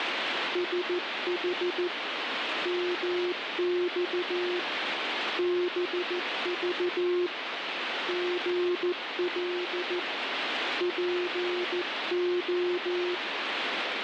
Morse code, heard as a keyed tone, hand-sent with a paddle, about 14 wpm, 360 Hz, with radio static. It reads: SH MX BV GL PO